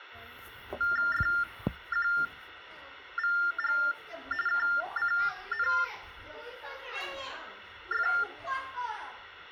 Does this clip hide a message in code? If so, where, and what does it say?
Yes: TTY/TDD text telephone tones (45.45 baud Baudot) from 0.8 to 8.2 s, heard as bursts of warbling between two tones, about 400 Hz shift, 1600 Hz centre, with phone line noise and the noise of a crowd indoors. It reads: FQVG KCNF